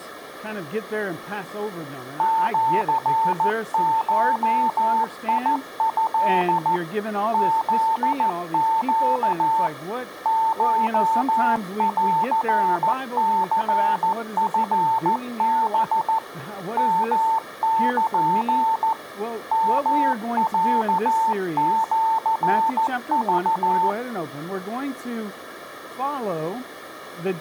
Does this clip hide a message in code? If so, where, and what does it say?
Yes: Morse code (Japanese Wabun code) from 2.1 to 24.0 s, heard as a keyed tone, machine-sent, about 14 wpm, 890 Hz. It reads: シゴト フネ コンニチハ ヨル ヨロシク